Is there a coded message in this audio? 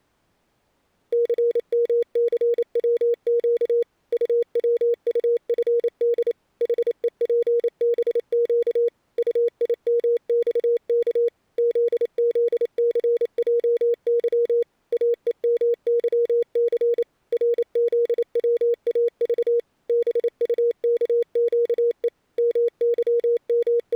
Yes: Morse code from 1.1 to 24.0 s, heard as a keyed tone, machine-sent, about 28 wpm, 470 Hz. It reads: CMCWQ UWUFD HEPBQ UIMXK ZZCJY AEMYC RZWAV BUKQE …